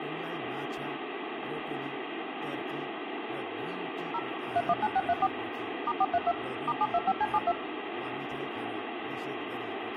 DTMF, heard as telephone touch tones, dialled by machine, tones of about 50 ms, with phone line noise and speech in Nepali. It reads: 0 319634 *432 *725C72